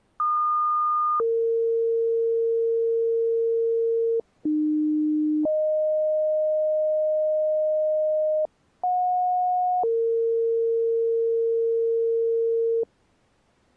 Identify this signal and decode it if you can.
Two-tone page, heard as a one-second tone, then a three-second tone, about 1220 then 460 Hz, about 300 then 620 Hz, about 730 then 460 Hz.